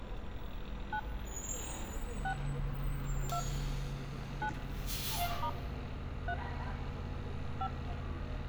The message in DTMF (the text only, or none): 9 6 2 9 * 3 5